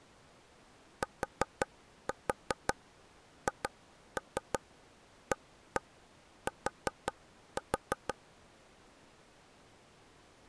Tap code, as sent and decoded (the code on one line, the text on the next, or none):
4-4 2-3 1-1 4-4
THAT